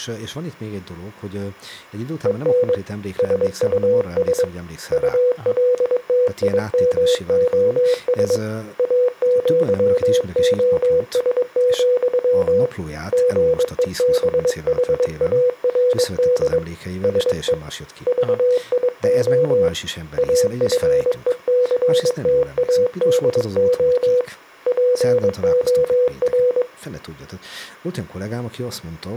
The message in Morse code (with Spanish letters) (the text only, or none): EN SUS ULTIMOS AÑOS, GEBHARD SE VIO AFECTADO POR